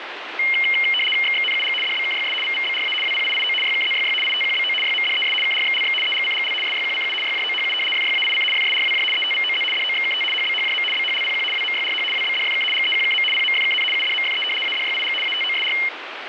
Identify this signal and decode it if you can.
RTTY (75 baud, 850 Hz shift), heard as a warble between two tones, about 2550 Hz centre, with radio static. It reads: XXNUG DBKYS VVBRA WPIIO YKZYY ITQBO YMDES KRXLX EGCGL SYQCU YJOHU FYAIC FSRWJ ETVOZ DOXKT HBHJM BHLPQ WMYRH WBDFK GEQKM PMFKN UDMFE ADYIG ATOSR